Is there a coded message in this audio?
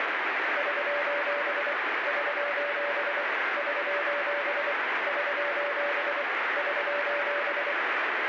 Yes: Morse code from 0.5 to 7.8 s, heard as a keyed tone, machine-sent, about 24 wpm, 580 Hz, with heavy radio static. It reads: <SOS> <SOS> <SOS> <SOS> <SOS>